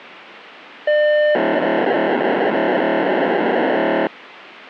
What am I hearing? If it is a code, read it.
POCSAG pager data (1200 baud), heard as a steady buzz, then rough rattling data, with radio hiss.